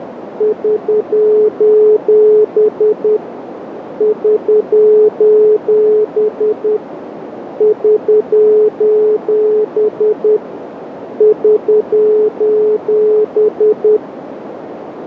Morse code, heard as a keyed tone, machine-sent, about 10 wpm, 430 Hz, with radio static and a narrow filter. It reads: <SOS> <SOS> <SOS> <SOS>